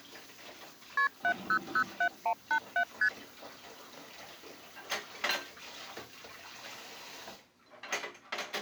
Multi-frequency trunk signalling (R1, as on North American trunks), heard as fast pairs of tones, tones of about 80 ms, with kitchen noise. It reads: KP 7007187 ST